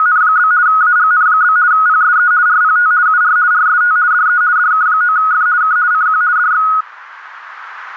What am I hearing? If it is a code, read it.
RTTY (50 baud, 170 Hz shift), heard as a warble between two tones, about 1360 Hz centre, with radio static. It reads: … AGN? PSE RPT UR RST DE DK9F K CQ DX